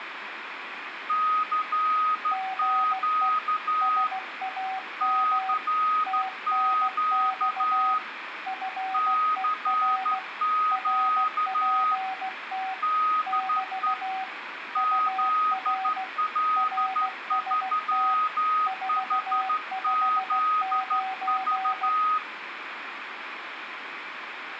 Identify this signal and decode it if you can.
Morse code, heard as two keyed tones, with radio static. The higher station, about 13 wpm, 1250 Hz: CQ CQ CQ DE ZL3HZV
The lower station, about 16 wpm, 760 Hz: GE SAM TNX FER RPT <BT> UR RST 459